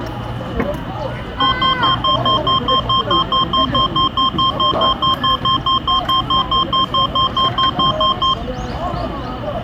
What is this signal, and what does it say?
Evenly repeated beeps, with room echo and the noise of a park. There is no code.